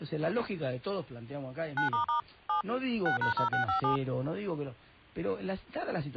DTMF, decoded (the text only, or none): 9** 7 6#0657